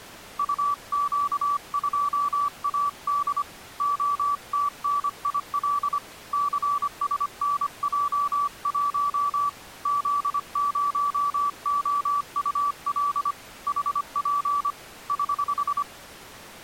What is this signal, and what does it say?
Morse code, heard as a keyed tone, hand-sent with a paddle, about 25 wpm, 1150 Hz. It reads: UQ2AD OTNIL CSNJ1 Z0OUL HP <HH>